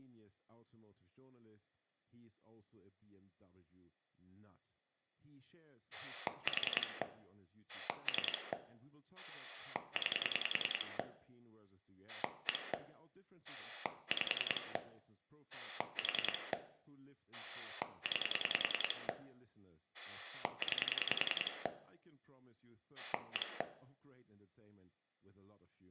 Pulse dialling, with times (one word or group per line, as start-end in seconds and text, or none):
5.9-7.0 4
7.7-8.5 3
9.2-11.0 9
12.1-12.7 1
13.4-14.8 5
15.5-16.5 4
17.3-19.1 9
19.9-21.7 9
23.0-23.6 1